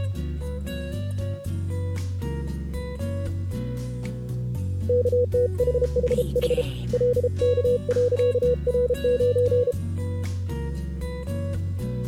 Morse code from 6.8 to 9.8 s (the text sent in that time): LK.R9